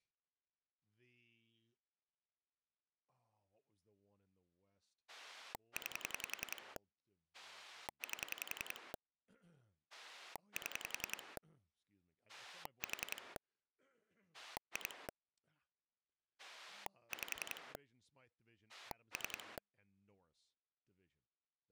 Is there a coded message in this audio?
Yes: pulse dialling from 5.1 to 19.6 s, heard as a rotary dial, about 10 pulses a second, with speech in English. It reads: 9 8 7 4 2 5 3